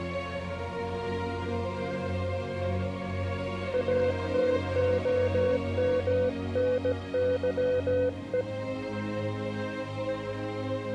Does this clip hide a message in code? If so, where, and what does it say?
Yes: Morse code (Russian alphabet) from 3.7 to 8.5 s, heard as a keyed tone, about 17 wpm, 500 Hz. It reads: АТОМНЫЕ